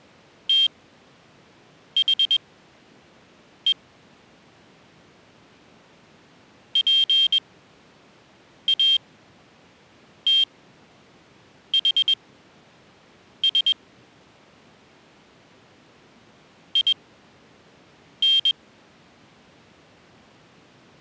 Morse code, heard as a high beeper, machine-sent, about 21 wpm, spaced as for 6 wpm, 3200 Hz. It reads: THE PATHS IN